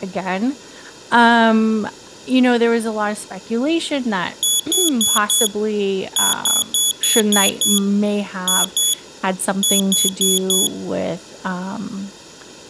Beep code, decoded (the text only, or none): 4-6-2-4